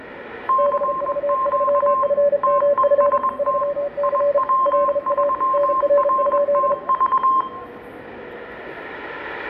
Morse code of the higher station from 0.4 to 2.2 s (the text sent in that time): CQ